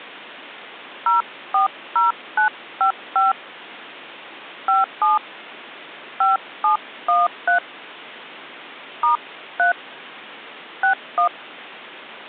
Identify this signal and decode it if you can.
DTMF, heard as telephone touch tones, dialled by hand, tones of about 130 ms. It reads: 040955 57 5713 *3 61